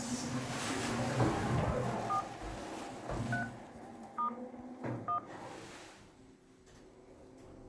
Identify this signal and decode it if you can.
DTMF, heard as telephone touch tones, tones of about 100 ms, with the noise inside a lift. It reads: 4 3 * 1